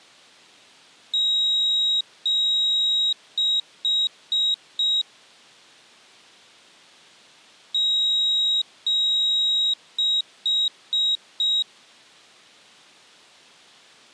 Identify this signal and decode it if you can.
Beep code, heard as a piezo beeper, played twice, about 3800 Hz. 2 long, 4 short.